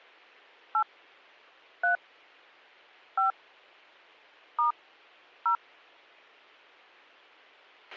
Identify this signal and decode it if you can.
DTMF, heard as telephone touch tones, dialled by hand, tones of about 130 ms, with a squelch burst at the end. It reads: 8 3 5 * 0